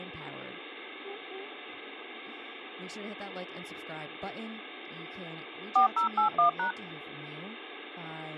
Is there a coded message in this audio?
Yes: DTMF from 5.8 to 6.7 s, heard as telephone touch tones, dialled by machine, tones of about 110 ms, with speech in English. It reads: 4081#